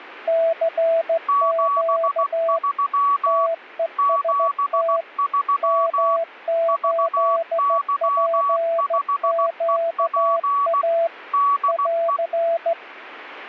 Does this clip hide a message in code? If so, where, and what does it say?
Yes: Morse code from 0.2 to 12.8 s, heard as two keyed tones. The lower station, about 15 wpm, 660 Hz: CQ TEST M8PQA <AR>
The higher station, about 16 wpm, 1130 Hz: 73 73 VY5EP DE